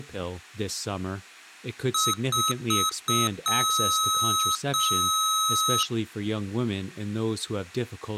Beep code, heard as beeps from a small speaker, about 1280 Hz, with speech in English. 4 short, 2 long.